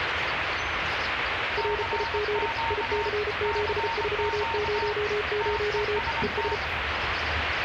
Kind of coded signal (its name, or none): Morse code